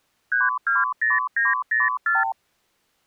Multi-frequency trunk signalling (R2, with the far end's replies), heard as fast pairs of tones, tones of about 170 ms. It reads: 320904